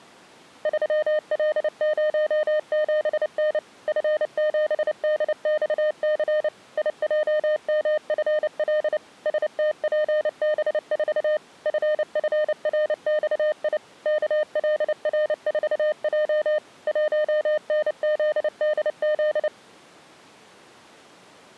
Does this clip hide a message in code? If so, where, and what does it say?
Yes: Morse code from 0.6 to 19.5 s, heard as a keyed tone, machine-sent, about 29 wpm, 610 Hz. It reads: 3L07N F7DXC IJMFL STPB4 FFRXI KLR4J 1NZDZ